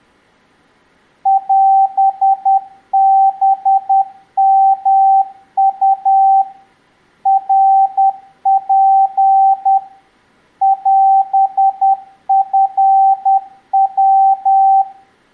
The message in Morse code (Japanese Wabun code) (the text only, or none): オハヨウ ナツ オチヤ